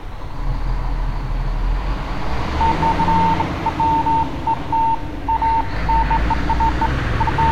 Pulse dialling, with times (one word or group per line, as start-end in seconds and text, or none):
none